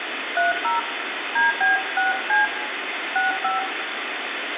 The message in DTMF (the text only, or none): 30 DB6C 65